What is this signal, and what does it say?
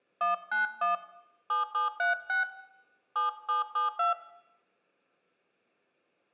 DTMF, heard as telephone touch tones, dialled by hand, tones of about 140 ms, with room echo. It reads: 191 7736 7772